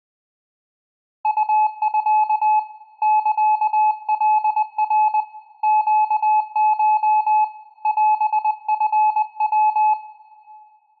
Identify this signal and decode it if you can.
Morse code (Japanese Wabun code), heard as a keyed tone, hand-sent with a paddle, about 20 wpm, 860 Hz, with room echo. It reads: ウミ サカナ ネコ オチヤ